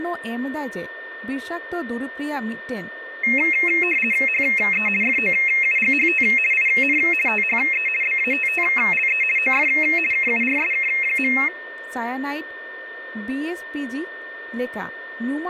RTTY (50 baud, 450 Hz shift), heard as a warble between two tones, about 2350 Hz centre, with a steady whistle near 1810 Hz, room echo and speech in Santali. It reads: HE FOUGHT IN THE BATTLE OF KURSK.